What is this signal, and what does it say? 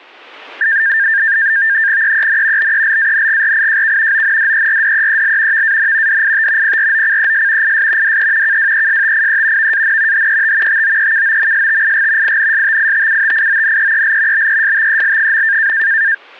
NAVTEX (SITOR-B), 100 baud, 170 Hz shift, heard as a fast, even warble, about 1700 Hz centre, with static crashes. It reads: EEN BELANGRIJK ONDERDEEL VAN DIT PROCES IS DE KWESTIE VAN HET TOEKOMSTIG INSTITUTIONEEL BESTEL.